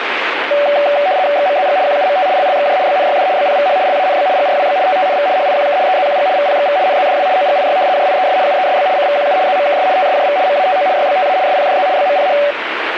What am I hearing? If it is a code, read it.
RTTY (75 baud, 170 Hz shift), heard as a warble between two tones, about 660 Hz centre, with radio static. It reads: XMZG QUMT LLXJ BNYD BPVH LANB GRWB TTNV HIQK EZQG VPXV NZDW OGIY JIES UESB CVQU ZMKS TSJV MATO YBTA SPDZ BMPH